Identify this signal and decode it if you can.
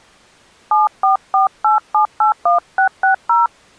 DTMF, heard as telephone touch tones, dialled by hand, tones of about 130 ms. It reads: 7448781660